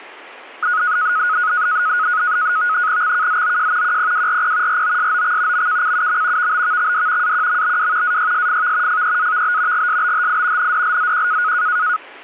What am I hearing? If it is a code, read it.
NAVTEX (SITOR-B), 100 baud, 170 Hz shift, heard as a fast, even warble, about 1360 Hz centre. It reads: XKZOJ QPWRP ROSOX MKCUM VBVXD AQMBW AYSFV FEAVB GSBHI NDLZQ